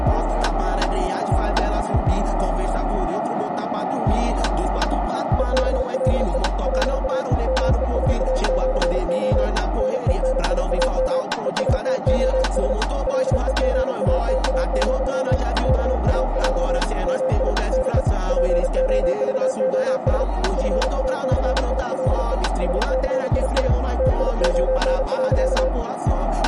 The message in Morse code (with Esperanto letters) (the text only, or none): EBLE LA MESAĜO NENIAM ESTOS LEGATA, KAJ MI NE POVOS FACILE SCII TION.